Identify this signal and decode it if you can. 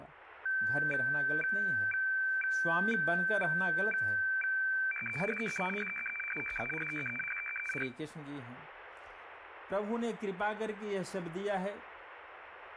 Weather fax (radiofax), 120 lines a minute, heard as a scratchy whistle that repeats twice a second, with speech in Hindi.